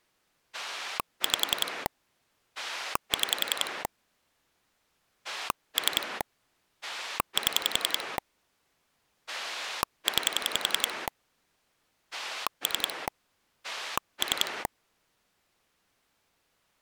Pulse dialling, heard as a rotary dial, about 10 pulses a second. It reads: 5 6 3 7 9 3 3